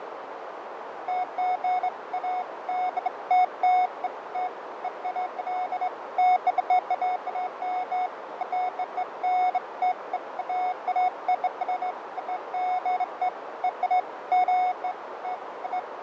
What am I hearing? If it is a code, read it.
Beeps of irregular length, with radio static, fading and a narrow filter. There is no code.